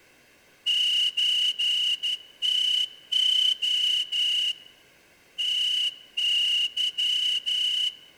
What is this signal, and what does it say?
Morse code (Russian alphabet), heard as a whistle, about 12 wpm, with room echo. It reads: ЧТО ТЫ